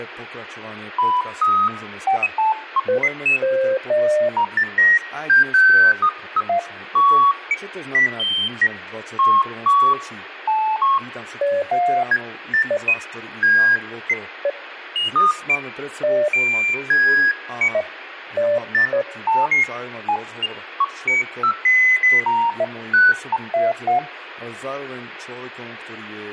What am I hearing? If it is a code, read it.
Electronic bleeps of random pitch and length, with radio hiss and speech in Slovak. There is no code.